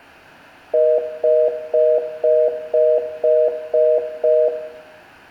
Telephone call progress tone (North American plan), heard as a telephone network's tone, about 480, 620 Hz, 0.25 s on and 0.25 s off, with room echo. Congestion tone.